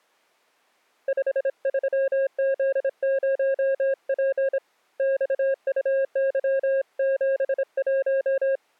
Morse code, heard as a keyed tone, hand-sent with a bug key, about 26 wpm, 540 Hz. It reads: 53Z0P XUY71